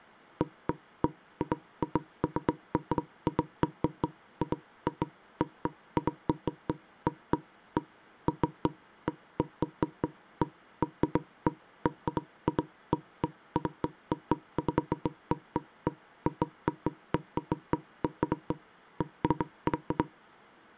Irregular knocks on wood. There is no code.